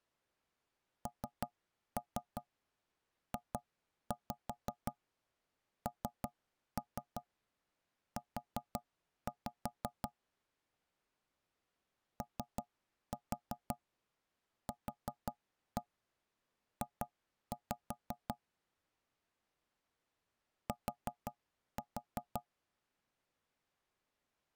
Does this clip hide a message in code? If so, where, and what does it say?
Yes: tap code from 1.1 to 22.5 s, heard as knocks on wood, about 5 knocks a second. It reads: NJNU OQJ T